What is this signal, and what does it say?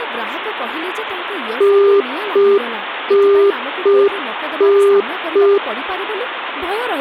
Telephone call progress tone (UK plan), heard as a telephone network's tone, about 400 Hz, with speech in Odia. Congestion tone.